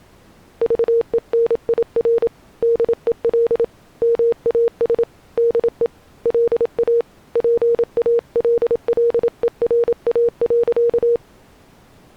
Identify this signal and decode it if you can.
Morse code, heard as a keyed tone, hand-sent with a paddle, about 27 wpm, 470 Hz. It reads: VENIR DEL MAS DE LA PALLERA.